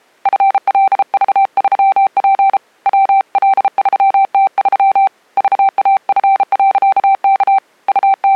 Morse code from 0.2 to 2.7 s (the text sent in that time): FLV3P